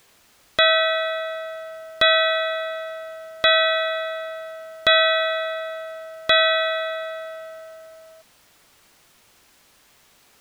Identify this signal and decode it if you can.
Clock strike, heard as a bell. 5. Five o'clock.